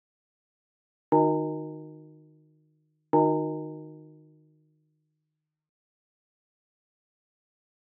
Clock strike, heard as a bell, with room echo. 2. Two o'clock.